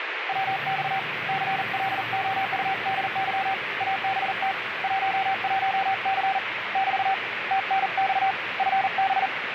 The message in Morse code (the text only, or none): WX CLOUDY ABT 11C <BT> TNX FB